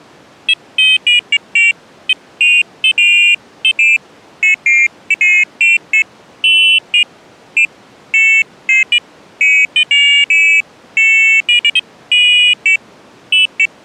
Pairs of high tones at irregular times. There is no code.